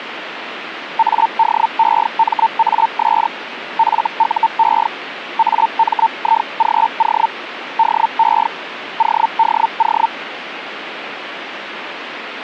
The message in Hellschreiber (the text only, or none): ADEMAS FUE AMIGO DE ODO